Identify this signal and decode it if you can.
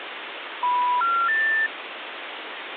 Telephone call progress tone (North American plan), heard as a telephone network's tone, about 980, 1370, 1800 Hz, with phone line noise. Special information tone.